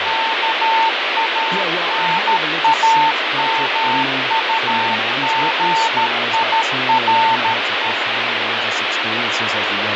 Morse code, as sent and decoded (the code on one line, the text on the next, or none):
-.- .- -. .- -- ..- --. .. .-. .
KANAMUGIRE